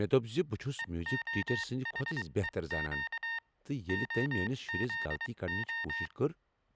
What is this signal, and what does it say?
Morse code (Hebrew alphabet), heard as electronic beeps, machine-sent, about 23 wpm, spaced as for 20 wpm, 920 Hz, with speech in Kashmiri. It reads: והחוק הזה